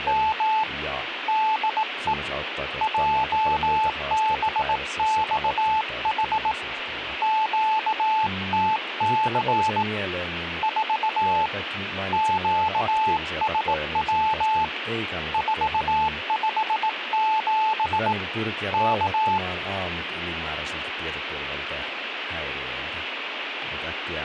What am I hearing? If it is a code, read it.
Morse code, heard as a keyed tone, hand-sent with a bug key, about 18 wpm, 870 Hz, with radio static and speech in Finnish. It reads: … DE JBXH QTC 4 QSW 457 K